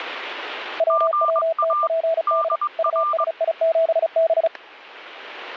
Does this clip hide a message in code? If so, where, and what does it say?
Yes: Morse code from 0.7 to 4.5 s, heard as two keyed tones, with static crashes. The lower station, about 35 wpm, 650 Hz: WWTPD USI7B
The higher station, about 21 wpm, 1190 Hz: GA DR